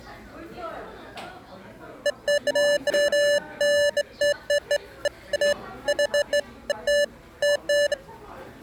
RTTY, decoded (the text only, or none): none